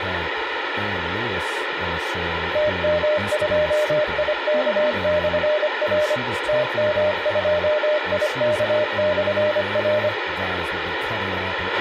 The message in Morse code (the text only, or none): TM2IK/R TM2IK/R